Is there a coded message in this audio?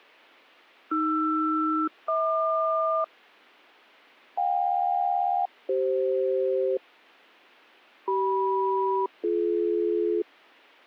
Yes: aircraft SELCAL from 0.9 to 10.2 s, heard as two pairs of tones. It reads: AR-HQ JK-CF CM-BD